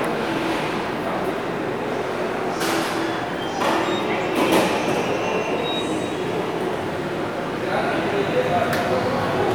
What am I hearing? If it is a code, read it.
The noise of a subway station. There is no code.